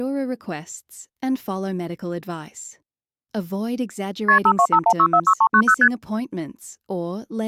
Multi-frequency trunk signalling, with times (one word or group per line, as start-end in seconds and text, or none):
4.3-4.4 KP
4.5-5.7 5251646390
5.8-5.9 ST